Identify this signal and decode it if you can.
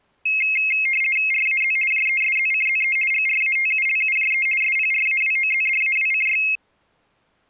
RTTY (50 baud, 450 Hz shift), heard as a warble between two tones, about 2350 Hz centre. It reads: RAZ JESZCZE GRATULUJE SPRAWOZDAWCY